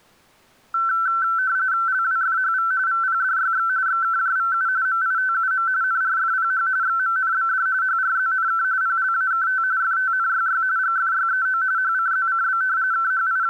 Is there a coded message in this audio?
Yes: RTTY (45.45 baud, 170 Hz shift) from 0.7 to 13.5 s, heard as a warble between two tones, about 1440 Hz centre. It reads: LWFHV VPDYX XKJVU MITUM NRFPH XMNBD HRZNK PLAKT FTNYY GFYEO HCZCB …